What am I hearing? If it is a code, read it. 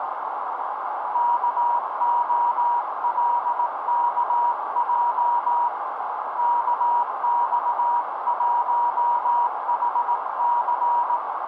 Morse code, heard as a keyed tone, hand-sent with a paddle, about 18 wpm, 960 Hz, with heavy radio static and a narrow filter. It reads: KOLKJ KX1HC